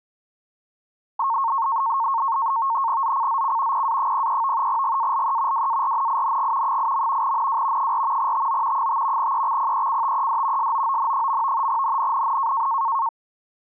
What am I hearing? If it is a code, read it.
NAVTEX (SITOR-B), 100 baud, 170 Hz shift, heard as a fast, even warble, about 1000 Hz centre. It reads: ZCZC PA03 GALE WARNING 8. NW 4 TO 5 EXPECTED SOON. NNNN